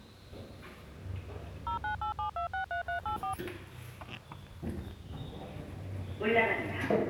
DTMF, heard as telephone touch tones, dialled by machine, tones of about 110 ms, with the noise inside a lift. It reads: 0987263384